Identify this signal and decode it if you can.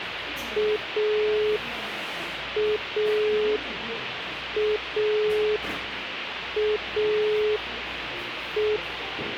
Telephone call progress tone (pulsed, as in Italy), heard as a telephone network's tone, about 420 Hz, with phone line noise and the noise of a cafe. Dial tone.